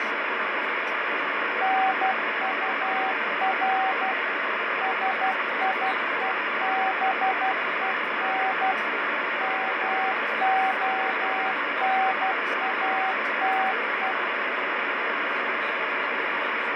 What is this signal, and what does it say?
Morse code, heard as a keyed tone, machine-sent, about 12 wpm, 760 Hz, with heavy radio static and fading. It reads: NUR SIEBEN MONATE